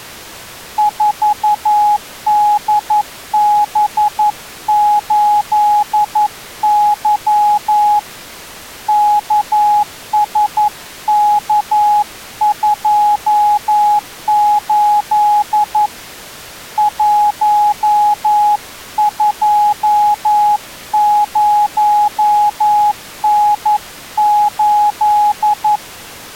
Morse code, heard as a keyed tone, hand-sent with a paddle, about 11 wpm, 840 Hz. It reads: 4DB8Y KSK28 120N8